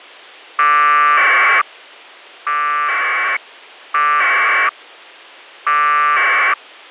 Packet radio (AX.25, as in APRS), 1200 baud, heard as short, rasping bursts.